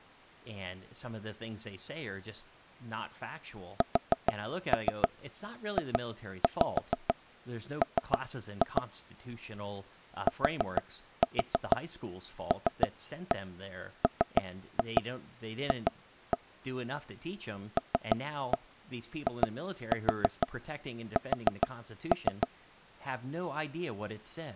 Tap code, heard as taps on a table, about 6 knocks a second, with speech in English. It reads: SJM TLMF LIS